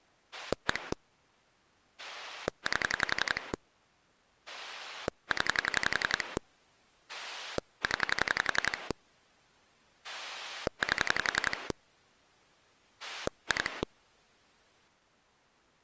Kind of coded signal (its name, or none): pulse dialling